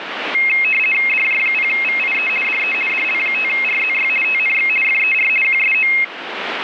RTTY (50 baud, 450 Hz shift), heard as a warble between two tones, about 2350 Hz centre, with radio static. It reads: DJ0VIE DE DL5RZY TNX FER QSO